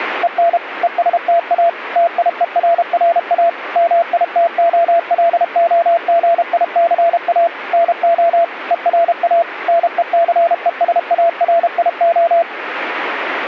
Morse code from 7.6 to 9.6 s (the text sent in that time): NO ERA